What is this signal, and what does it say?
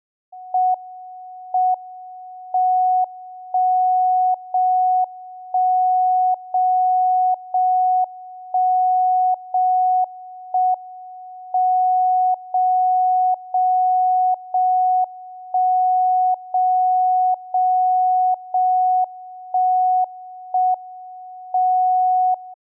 Radio time signal (JJY), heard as a tone whose level steps once a second, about 740 Hz. The time is 13:55 Japan time. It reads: M M 1 0 1 0 0 1 0 1 M 0 0 0 1 0 0 0 1 1 M 0